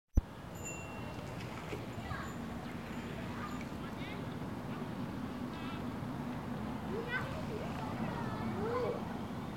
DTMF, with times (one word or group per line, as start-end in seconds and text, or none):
none